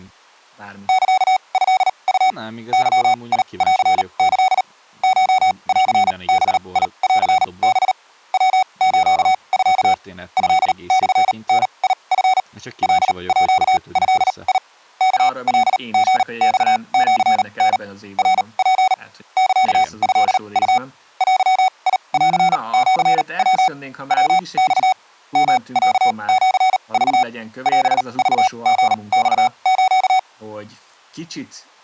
Morse code (Japanese Wabun code), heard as electronic beeps, machine-sent, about 38 wpm, spaced as for 28 wpm, 750 Hz, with speech in Hungarian. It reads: サトウ ゲンキ コンバンハ ヤスミ トモダチ カード ワカリマシタ ナツ サトウ デンシヤ ヤマ ヨロシク オクリマス